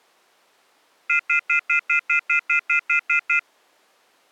Telephone call progress tone (North American plan), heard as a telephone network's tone, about 1400, 2050, 2450, 2600 Hz, 0.1 s on and 0.1 s off. Off-hook warning tone.